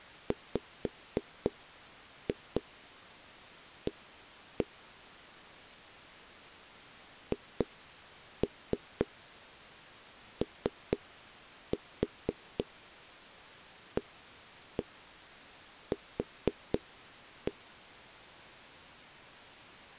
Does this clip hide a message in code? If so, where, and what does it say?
Yes: tap code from 0.3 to 17.6 s, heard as knocks on wood, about 4 knocks a second. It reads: WA HOAQ